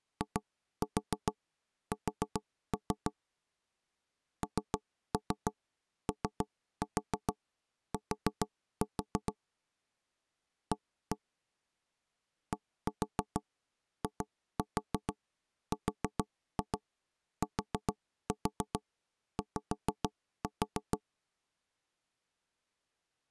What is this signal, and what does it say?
Tap code, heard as knocks on wood, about 6 knocks a second. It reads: IS NOT A DIRTY